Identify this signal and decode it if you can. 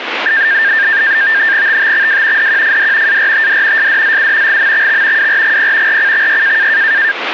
NAVTEX (SITOR-B), 100 baud, 170 Hz shift, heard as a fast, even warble, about 1700 Hz centre, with radio static. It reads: TTXW DQFD ARTD SDZU GMXX WRGP RCXY